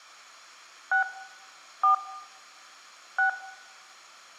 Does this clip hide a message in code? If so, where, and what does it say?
Yes: DTMF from 0.9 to 3.3 s, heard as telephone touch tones, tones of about 110 ms, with room echo. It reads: 6 4 6